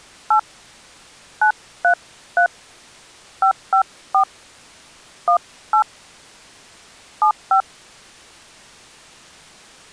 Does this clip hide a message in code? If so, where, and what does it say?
Yes: DTMF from 0.3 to 7.6 s, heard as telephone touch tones, dialled by hand, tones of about 90 ms. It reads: 8 933 554 18 75